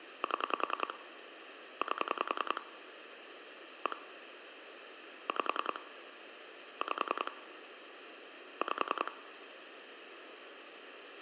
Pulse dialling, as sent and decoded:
7 / 8 / 1 / 5 / 5 / 5
7 8 1 5 5 5

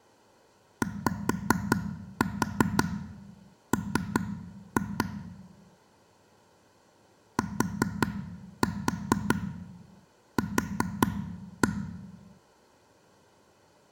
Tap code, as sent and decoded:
5-4 3-2 / 4-4 4-1
YM TQ

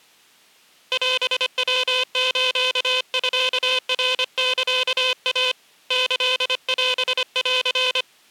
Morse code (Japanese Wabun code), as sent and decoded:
.-... .-- ---.- ..-.- .-. -.-.- .- / -.-.. .-... .-.-.
オヤスミナサイ キオン

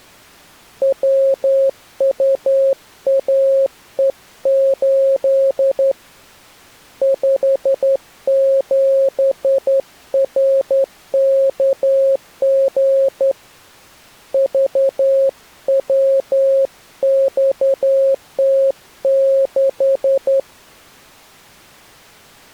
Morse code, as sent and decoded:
.-- ..- .- . ---.. / ..... --... .-. -.- --. / ...- .-- -..- - -....
WUAE8 57RKG VWXT6

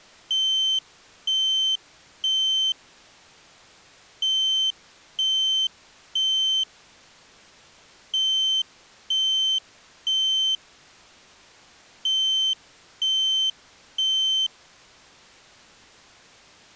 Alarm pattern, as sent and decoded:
3 beeps and a pause
temporal three

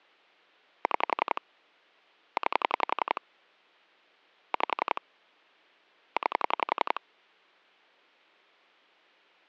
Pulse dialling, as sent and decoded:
6 / 9 / 5 / 9
6 9 5 9

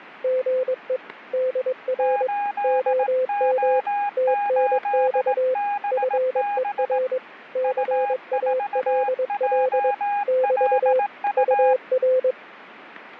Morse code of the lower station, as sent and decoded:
--. . / -.. .-. / --- -- / - -. -..- / ..-. . .-. / -.-. .- .-.. .-.. / -...- / ..- .-.
GE DR OM TNX FER CALL <BT> UR

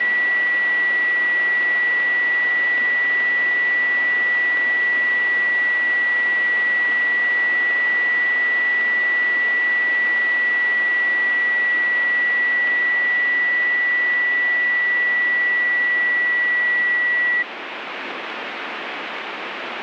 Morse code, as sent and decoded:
none

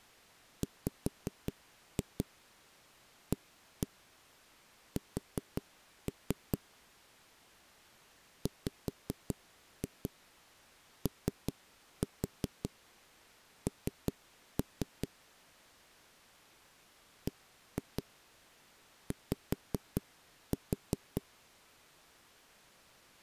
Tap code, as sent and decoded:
5-2 1-1 4-3 / 5-2 3-4 3-3 / 1-2 5-4
WAS WON BY

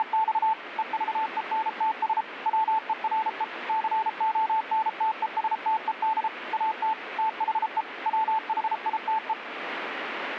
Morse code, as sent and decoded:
… / . ...- . -. - ... / .-- . .-. . / -.-. --- -. - . ... - . -.. / .- - / - .... . / .-- .... .. - .
… EVENTS WERE CONTESTED AT THE WHITE

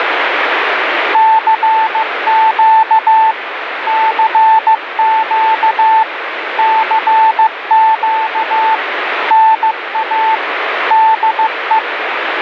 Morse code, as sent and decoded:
-.-. --.- / -.-. --.- / -.-. --.- / -. .- / -.. .
CQ CQ CQ NA DE

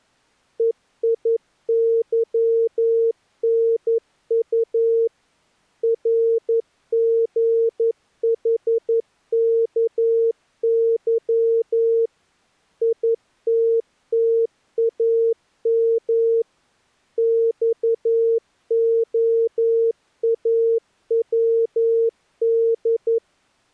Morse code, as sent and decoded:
. .. -.-- -. ..- / .-. --. .... -.- -.-- / .. - - .- -- / -..- --- .- .-- -..
EIYNU RGHKY ITTAM XOAWD

